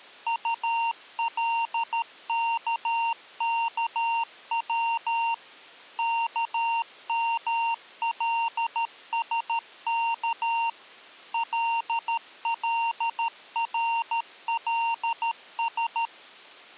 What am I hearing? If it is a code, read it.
Morse code, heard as electronic beeps, machine-sent, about 13 wpm, 920 Hz. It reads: ULKKW KMLSK LLRLS